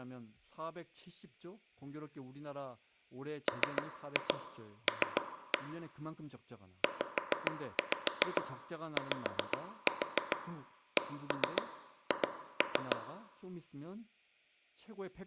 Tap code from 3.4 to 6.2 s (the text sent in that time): ML